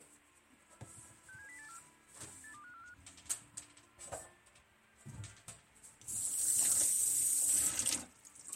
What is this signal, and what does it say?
Five-tone selective call (CCIR), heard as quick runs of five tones, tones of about 100 ms, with radio hiss and kitchen noise. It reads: 67084 82545